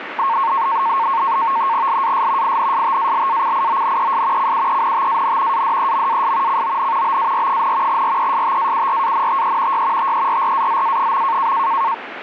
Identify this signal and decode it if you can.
NAVTEX (SITOR-B), 100 baud, 170 Hz shift, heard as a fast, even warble, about 1000 Hz centre, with radio static. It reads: LAS INSTALACIONES CUENTAN ADEMAS CON BAR, RESTAURANTE Y TERRAZA.